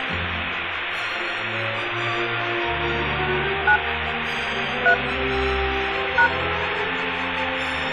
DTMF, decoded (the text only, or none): 9 3 #